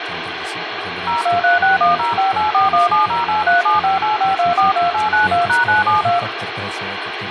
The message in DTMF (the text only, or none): 023610584170837585242892#972